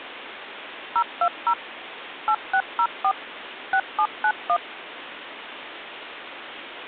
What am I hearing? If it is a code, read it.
DTMF, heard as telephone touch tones, dialled by machine, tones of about 70 ms, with phone line noise. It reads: 020 8604 6791